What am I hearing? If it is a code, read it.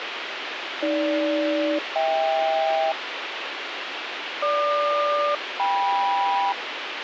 Aircraft SELCAL, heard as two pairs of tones, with radio hiss. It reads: AG-HK GQ-KM